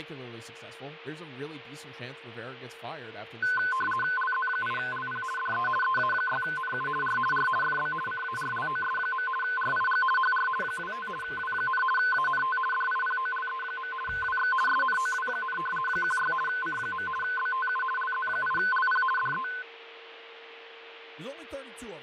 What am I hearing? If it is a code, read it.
RTTY (50 baud, 450 Hz shift), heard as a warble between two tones, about 1270 Hz centre, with radio static, fading, a steady whistle near 460 Hz and speech in English. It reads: LZ8LP DE EA6NU R R FB CARLOS. RIG HR 25 W, ANT DIPOLE. WX SNOW, 16 C. BTU LZ8LP DE